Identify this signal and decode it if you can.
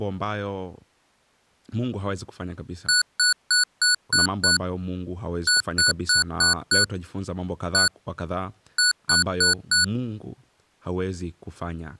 Beep code, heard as beeps from a small speaker, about 1470 Hz, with speech in Swahili. 6-5-1-4.